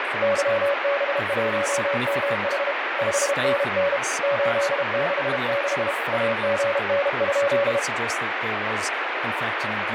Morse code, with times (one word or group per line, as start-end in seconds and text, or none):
0.2-2.7 YB1MH
3.0-4.0 5NN
4.2-5.9 866
6.1-7.8 AGN?